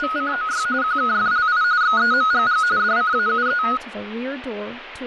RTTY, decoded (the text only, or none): … QKFLI XEMGG DCAUE